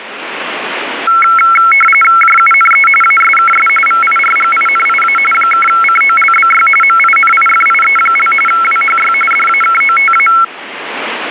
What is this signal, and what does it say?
RTTY (45.45 baud, 850 Hz shift), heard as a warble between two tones, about 1750 Hz centre, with radio static. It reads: JUNE ASKS VIRGINIA (COLBY MINIFIE) WHY DAKOTA